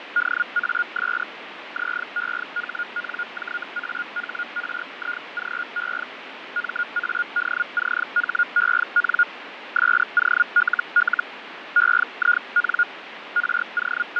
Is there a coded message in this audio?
Yes: Hellschreiber (Feld-Hell, 122.5 baud) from 0.2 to 14.2 s, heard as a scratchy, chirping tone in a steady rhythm, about 1430 Hz, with radio static and fading. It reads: DAS ZEHNJAHRIGE MADCHEN SOLL EIN …